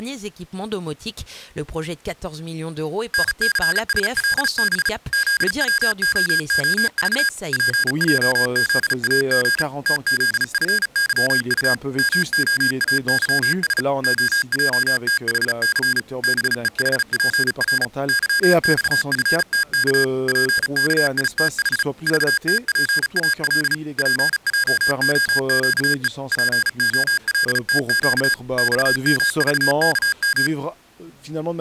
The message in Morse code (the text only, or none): NCSLB ZWOOV PJZAG TZFYU MOAYS OJTHC BEHPR YXFTK PKITH VTPAL PJOQE POLTQ XMVKM